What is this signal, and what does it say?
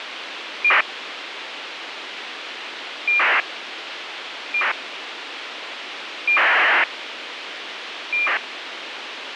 ACARS aircraft data, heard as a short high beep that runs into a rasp, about 2400 baud, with radio hiss.